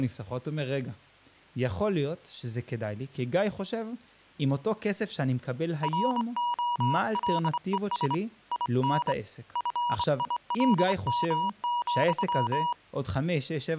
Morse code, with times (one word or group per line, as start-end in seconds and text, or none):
5.8-8.1 ROLES
8.5-9.1 IN
9.6-12.7 FILM,